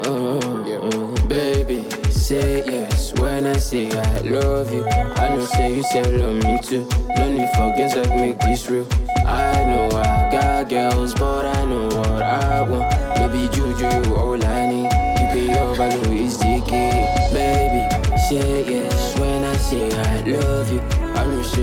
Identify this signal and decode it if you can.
Morse code, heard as a keyed tone, hand-sent with a straight key, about 8 wpm, 730 Hz. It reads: HELP HELP